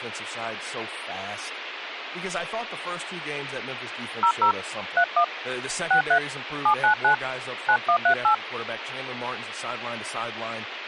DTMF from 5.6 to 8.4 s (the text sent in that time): 63 799 9138